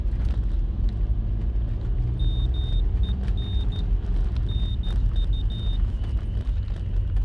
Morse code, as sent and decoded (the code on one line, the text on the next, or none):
-- . -. / -. ..-
MEN NU